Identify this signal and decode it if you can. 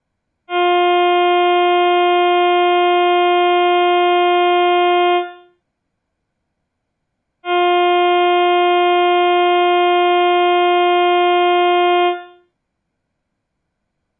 Ship horn signal, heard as a ship's horn, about 350 Hz, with room echo. 2 long. At sea: a vessel under power that has stopped in fog.